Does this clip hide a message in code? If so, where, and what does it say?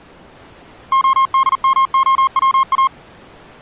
Yes: Morse code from 0.9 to 2.9 s, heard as a keyed tone, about 40 wpm, 1070 Hz. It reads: ODMOWA